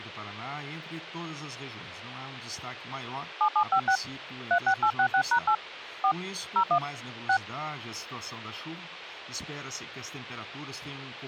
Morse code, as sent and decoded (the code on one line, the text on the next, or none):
none